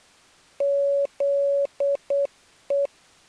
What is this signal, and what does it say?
Morse code (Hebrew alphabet), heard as a keyed tone, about 8 wpm, 560 Hz. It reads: זו